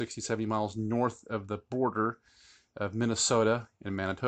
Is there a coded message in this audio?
No, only speech in English.